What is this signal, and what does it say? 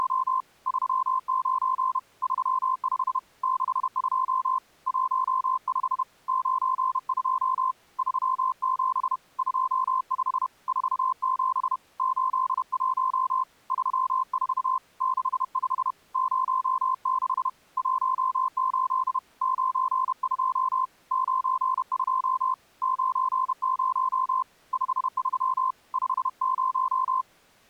Morse code, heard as a keyed tone, hand-sent with a paddle, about 31 wpm, 1040 Hz. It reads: … 39 35 62 15 92 37 25 47 81 34 65 06 18 92 92 90 53 50